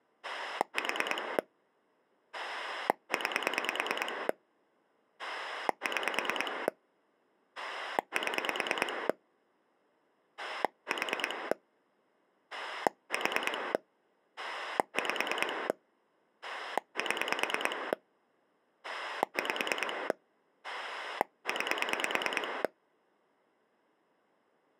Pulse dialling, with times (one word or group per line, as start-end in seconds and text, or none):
0.2-1.4 4
2.3-4.3 9
5.2-6.7 6
7.6-9.1 7
10.4-11.5 4
12.5-13.7 4
14.4-15.7 5
16.4-17.9 7
18.8-20.1 5
20.6-22.6 9